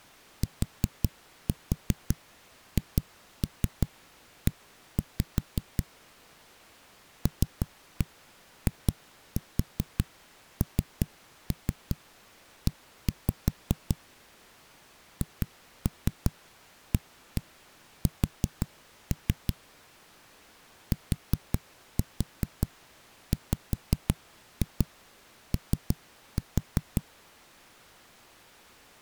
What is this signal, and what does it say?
Tap code, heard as knocks on a wall, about 5 knocks a second. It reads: THE LINE HAS TWO